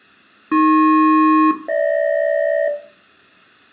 Aircraft SELCAL, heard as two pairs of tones, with room echo. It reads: AP-GH